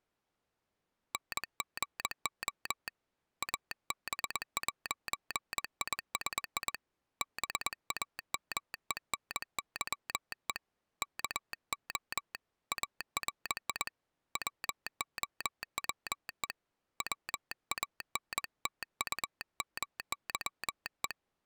Morse code, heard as a telegraph sounder, hand-sent with a paddle, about 21 wpm. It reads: NGO AB'ISI BAMENYE KO ARI WOWE WANTUMYE